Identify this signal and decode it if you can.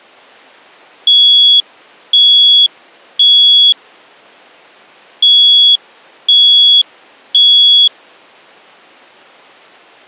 Alarm pattern, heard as an alarm's beeps, played twice, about 3350 Hz. Temporal three. Smoke or fire, evacuate.